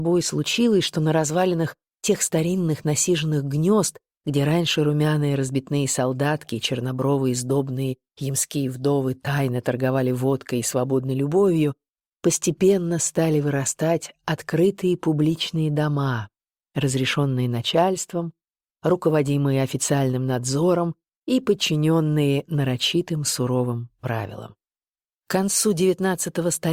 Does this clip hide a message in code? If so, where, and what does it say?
No.